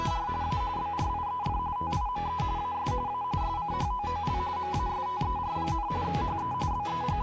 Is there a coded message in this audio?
Yes: RTTY (45.45 baud, 170 Hz shift) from 0.0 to 7.2 s, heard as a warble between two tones, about 910 Hz centre. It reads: … A BRIEF TIME AS A SCHOOL MASTER, HE …